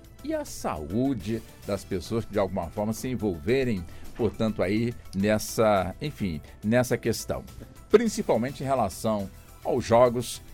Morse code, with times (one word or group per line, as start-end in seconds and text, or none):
none